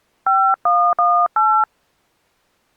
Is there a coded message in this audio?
Yes: DTMF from 0.3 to 1.6 s, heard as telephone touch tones, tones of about 280 ms. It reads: 5118